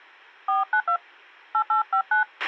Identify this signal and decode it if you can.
DTMF, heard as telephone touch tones, dialled by hand, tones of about 130 ms, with a squelch burst at the end. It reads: 492 8859